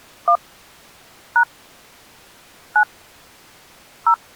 DTMF, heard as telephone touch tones, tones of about 80 ms. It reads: 1 # 9 0